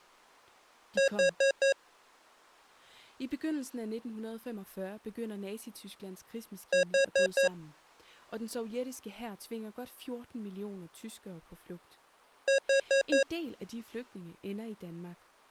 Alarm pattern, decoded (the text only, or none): temporal four